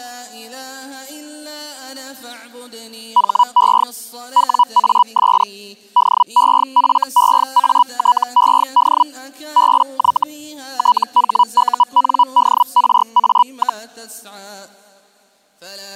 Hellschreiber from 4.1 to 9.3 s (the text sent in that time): WAS DEFEATED